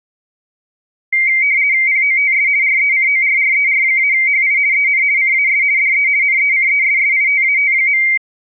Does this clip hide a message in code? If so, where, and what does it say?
Yes: RTTY (50 baud, 170 Hz shift) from 1.1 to 8.2 s, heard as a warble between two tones, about 2200 Hz centre. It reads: POTS RECORRER-HI EN CAS DE NECESSITAT.